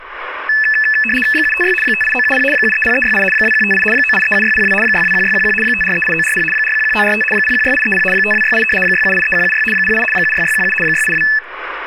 RTTY (75 baud, 850 Hz shift), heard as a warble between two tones, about 2150 Hz centre, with speech in Assamese. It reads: 756 58970 730368 2158 9837602 621611 5438940 411945 016830 5268 6783176 08 76617 682